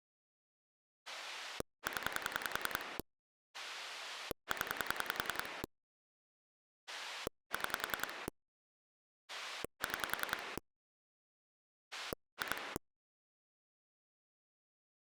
Pulse dialling, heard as a rotary dial, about 10 pulses a second. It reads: 0 0 6 6 2